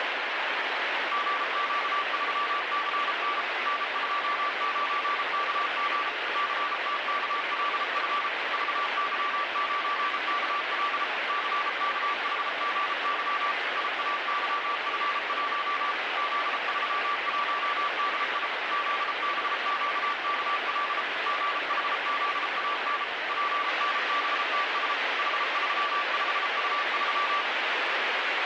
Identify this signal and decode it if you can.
Morse code, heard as a keyed tone, machine-sent, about 33 wpm, 1160 Hz, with heavy radio static. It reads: GQ3CN N29KG CTKLF VY9KL CKHGY IAYF1 Z31DI ZBQKL GHZAN PNBTS H35U3